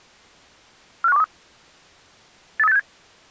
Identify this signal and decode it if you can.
Five-tone selective call (EEA), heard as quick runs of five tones, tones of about 40 ms. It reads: 45123 83867